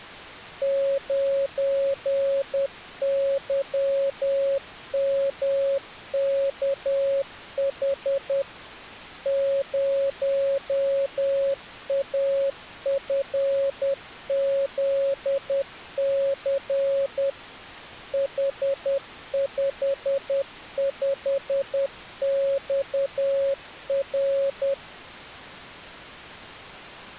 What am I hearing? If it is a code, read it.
Morse code, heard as a keyed tone, machine-sent, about 10 wpm, 550 Hz. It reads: 9YMKH 0AFZC H55XR